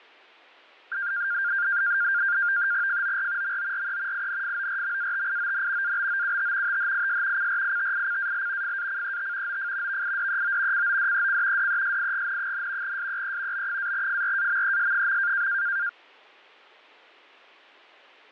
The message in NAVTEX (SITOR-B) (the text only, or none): FOR MORE INFORMATION ABOUT THIS CRITICAL FACET OF VIDEO CODEC DESIGN, SEE B-FRAMES.